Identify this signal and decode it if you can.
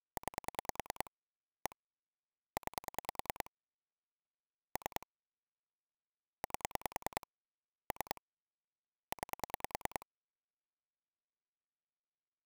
Pulse dialling, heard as clicks on a phone line, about 10 pulses a second. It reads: 9 1 9 3 8 3 9